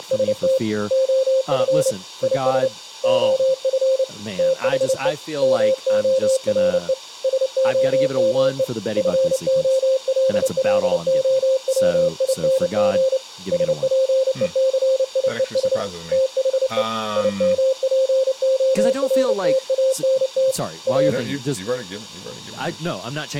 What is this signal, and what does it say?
Morse code, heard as a keyed tone, hand-sent with a paddle, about 29 wpm, 530 Hz, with speech in English. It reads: … OF IS OF THE MORE SOME FOLLOWING SPECIES THE IMPORTANT A